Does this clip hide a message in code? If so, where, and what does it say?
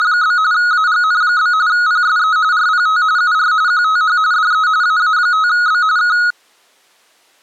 Yes: RTTY (45.45 baud, 170 Hz shift) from 0.0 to 6.3 s, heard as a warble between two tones, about 1360 Hz centre. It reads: … AGN? PSE RPT UR QTH DE AA5B K